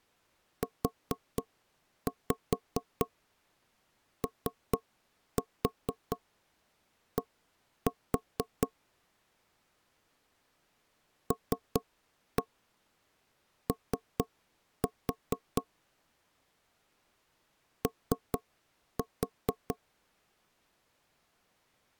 Tap code, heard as knocks on wood, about 4 knocks a second. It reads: UOD LO O